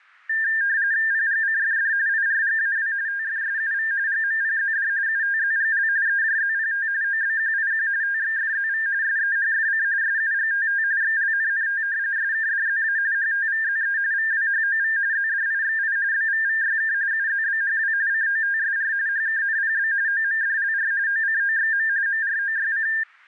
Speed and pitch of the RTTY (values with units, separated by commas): 45.45 baud, 170 Hz shift, 1700 Hz centre